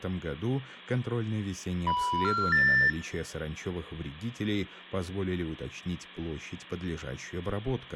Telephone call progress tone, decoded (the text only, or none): special information tone